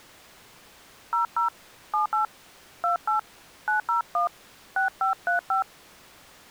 DTMF, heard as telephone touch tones, dialled by hand, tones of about 120 ms. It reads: 00 78 28 901 6535